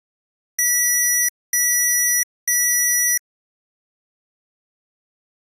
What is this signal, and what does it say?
Beep code, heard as beeps from a small speaker, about 1950 Hz. 3 long. In IBM BIOS tables: keyboard card error.